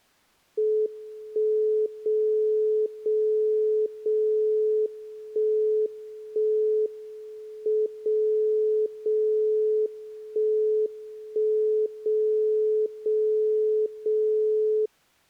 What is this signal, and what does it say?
Radio time signal (WWVB), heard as a tone whose level steps once a second, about 430 Hz. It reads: 1 0 0 0 1 1 M 0 0 1 1 0 0 0